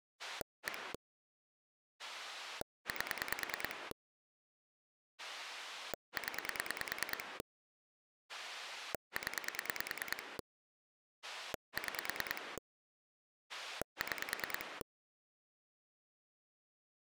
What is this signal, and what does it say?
Pulse dialling, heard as a rotary dial, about 9 pulses a second. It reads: 1 8 0 0 6 6